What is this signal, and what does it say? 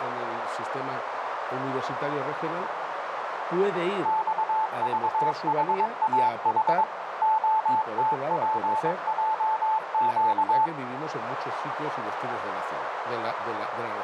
Morse code, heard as a keyed tone, machine-sent, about 22 wpm, 880 Hz, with radio static and a narrow filter. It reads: XVHAH OTPJQ